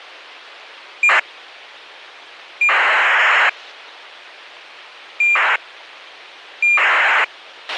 ACARS aircraft data, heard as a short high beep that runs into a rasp, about 2400 baud, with a squelch burst at the end.